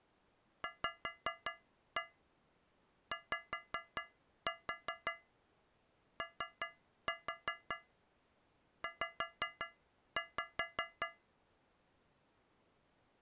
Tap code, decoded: VYOZ

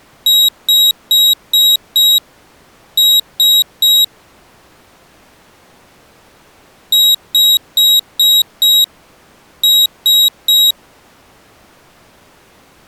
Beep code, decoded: 5-3

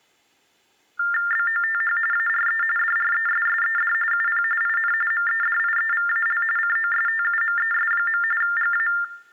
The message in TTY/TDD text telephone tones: BOTH ARE DRESSED UP IN MEDIEVAL COSTUMES. GA

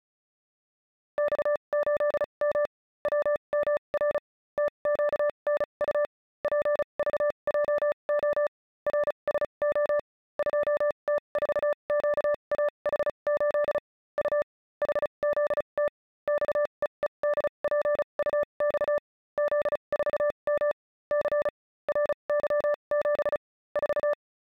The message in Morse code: X8M WMR TQNU PVJO RSO 2T4QAH8 U HZT XEEDPUX Z4M C RY7 4

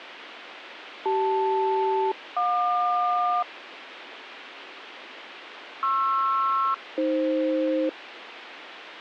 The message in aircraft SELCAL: CL-JQ PR-AF

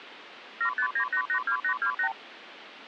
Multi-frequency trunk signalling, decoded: 759882828

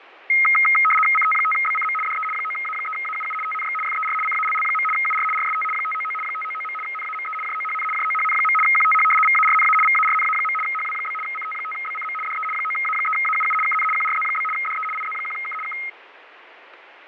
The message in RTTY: CT5BCM DE 9A3AUU TNX FER CALL. UR RST 599 599. NAME JOHN JOHN. QTH VARNA VARNA. HW? CT5BCM DE 9A3AUU KN QRZ? DE IZ1K K

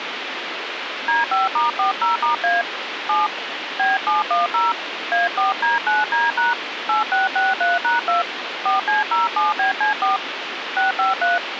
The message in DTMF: D5*40*A 7 B710 A4D9D# 8663#2 4C07BC4 653

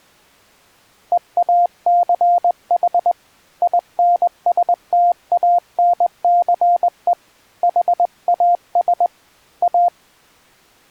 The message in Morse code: EACH INSTANCE HAS A

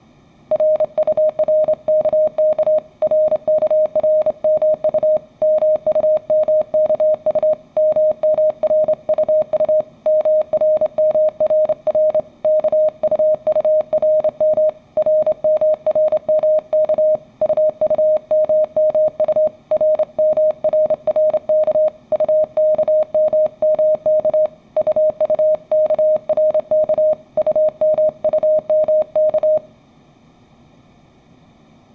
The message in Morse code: RURKK RKRMU MUMKU MMRUU MRMRR KUURM RMRMK UUMMU RMRRK UKMMK UUKRK UMUMK

